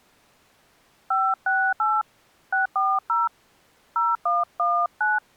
DTMF, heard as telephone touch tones, dialled by hand, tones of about 220 ms. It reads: 568 640 0119